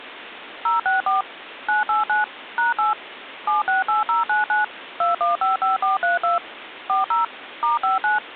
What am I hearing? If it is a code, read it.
DTMF, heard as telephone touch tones, dialled by machine, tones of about 150 ms, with phone line noise. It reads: 064 989 #8 768099 2155432 40 *59